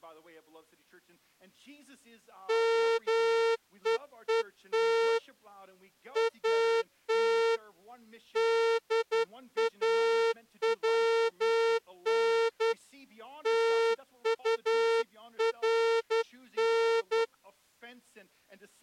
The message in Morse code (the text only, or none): MEET AT DAWN TURN